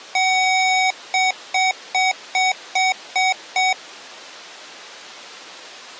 Beep code, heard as beeps from a small speaker, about 750 Hz. 1 long, 7 short.